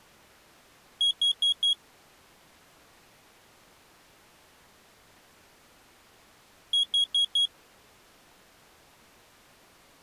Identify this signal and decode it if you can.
Alarm pattern, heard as an alarm's beeps, played twice, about 3300 Hz. Temporal four. Carbon monoxide.